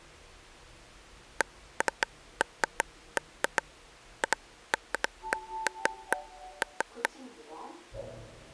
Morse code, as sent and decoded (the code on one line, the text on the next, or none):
none